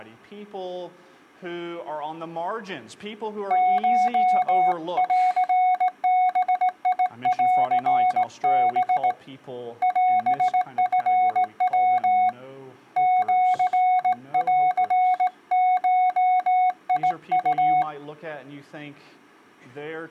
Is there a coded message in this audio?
Yes: Morse code (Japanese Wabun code) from 3.4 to 17.9 s, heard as a keyed tone, hand-sent with a straight key, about 18 wpm, 740 Hz. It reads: コンバンハ オチヤ シンゴウ